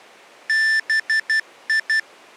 Morse code (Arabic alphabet), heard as electronic beeps, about 12 wpm, 1750 Hz. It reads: بي